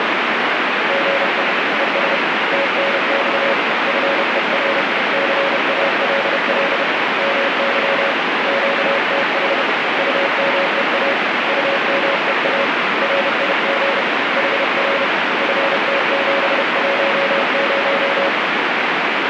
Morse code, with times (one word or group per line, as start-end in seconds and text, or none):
0.9-1.4 GE
1.8-2.2 ES
2.5-3.5 TNX
3.9-4.8 FER
5.1-6.8 CALL
7.2-8.1 MY
8.5-9.6 QTH
10.0-11.1 UMEA
11.5-12.6 UMEA
13.0-14.0 RIG
14.4-15.0 HR
15.4-18.3 FT710